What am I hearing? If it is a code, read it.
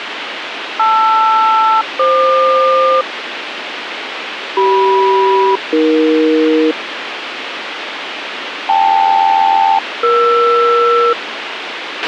Aircraft SELCAL, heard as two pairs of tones, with radio hiss and a squelch burst at the end. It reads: LR-FQ CM-AE KL-ER